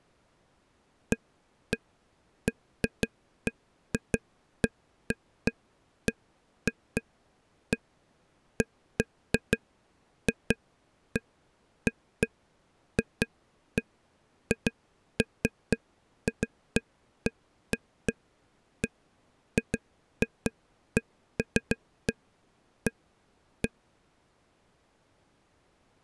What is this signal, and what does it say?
Irregular taps on a table. There is no code.